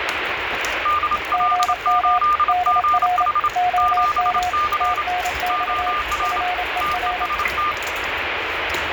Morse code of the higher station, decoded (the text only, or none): DL8GH 7C OR TEST